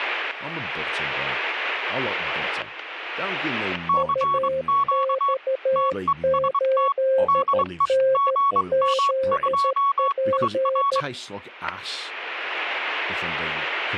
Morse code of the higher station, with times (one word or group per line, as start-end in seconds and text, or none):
3.9-5.3 CQ
5.8-6.9 TEST
7.3-7.9 DE
8.1-11.0 GM2IR